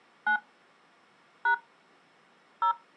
DTMF, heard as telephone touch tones, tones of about 100 ms. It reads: 9 # 0